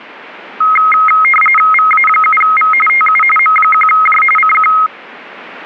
RTTY (45.45 baud, 850 Hz shift), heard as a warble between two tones, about 1700 Hz centre. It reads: VA7V TU M1J CQ